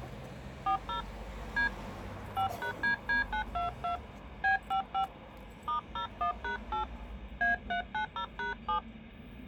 DTMF, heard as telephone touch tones, dialled by hand, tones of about 110 ms, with street noise. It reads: 40 D 5#DD922 B55 *01#8 A390#7